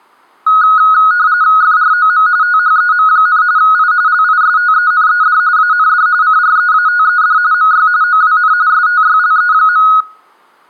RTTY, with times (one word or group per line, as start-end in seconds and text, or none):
1.6-2.3 FROM
2.4-3.4 THEM,
3.6-3.9 I
4.1-5.4 LISTENED
5.6-6.1 AND
6.2-7.4 CREATED
7.5-7.9 MY
8.0-8.5 OWN
8.7-9.9 STYLE.